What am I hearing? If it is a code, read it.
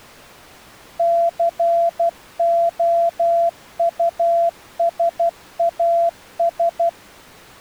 Morse code, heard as a keyed tone, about 12 wpm, 680 Hz. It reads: COUSAS